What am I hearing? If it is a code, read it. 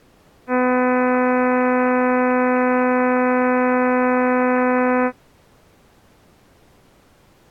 Ship horn signal, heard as a ship's horn, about 250 Hz. 1 long. At sea: a vessel nearing a blind bend, or under power and making way in fog.